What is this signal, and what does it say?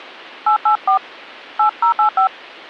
DTMF, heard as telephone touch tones, dialled by hand, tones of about 100 ms. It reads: 884 8085